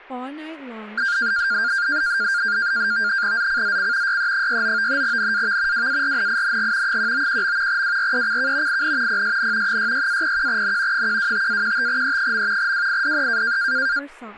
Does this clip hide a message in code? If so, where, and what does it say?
Yes: NAVTEX (SITOR-B), 100 baud, 170 Hz shift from 1.0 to 14.0 s, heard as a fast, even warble, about 1500 Hz centre, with speech in English. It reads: ZCZC YE69 NAV WARNING 191. WRECK IN PSN 66-01N 125-15E. WIDE